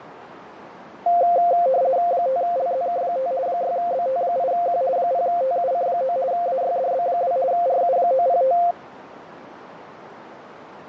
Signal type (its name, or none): RTTY